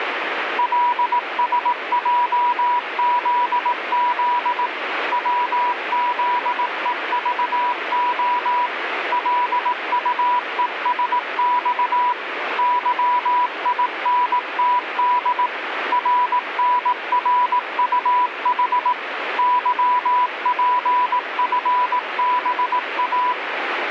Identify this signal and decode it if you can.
Morse code, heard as a keyed tone, machine-sent, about 18 wpm, 980 Hz, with radio static. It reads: LSJZZ WZEVO LUESX YINTD RNRUH YPFBA